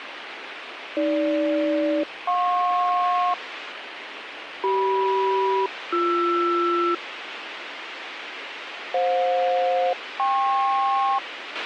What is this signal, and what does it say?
Aircraft SELCAL, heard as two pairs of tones, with radio hiss and a squelch burst at the end. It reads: AG-JP CM-BR FJ-KP